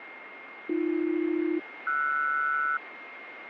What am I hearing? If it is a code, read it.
Aircraft SELCAL, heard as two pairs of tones, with radio static and a steady whistle near 2130 Hz. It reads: AB-RS